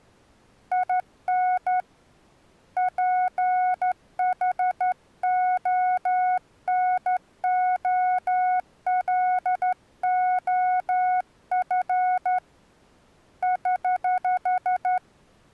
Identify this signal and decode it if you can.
Morse code, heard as a keyed tone, hand-sent with a straight key, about 12 wpm, 730 Hz. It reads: IN PHONOLOF <HH>